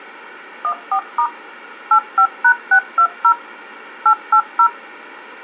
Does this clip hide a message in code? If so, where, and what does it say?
Yes: DTMF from 0.6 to 4.7 s, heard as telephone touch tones, dialled by machine, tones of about 80 ms. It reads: 14* 85#620 880